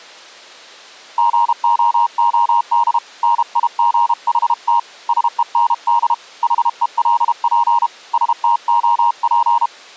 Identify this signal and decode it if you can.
Morse code, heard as a keyed tone, hand-sent with a paddle, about 32 wpm, 940 Hz. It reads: GOOD NIGHT SEND HELP STOP